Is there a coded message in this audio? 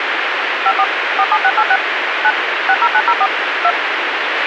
Yes: DTMF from 0.7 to 3.7 s, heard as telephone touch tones, dialled by machine, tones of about 60 ms, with radio hiss and a squelch burst at the end. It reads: 54 47686 9 60904 2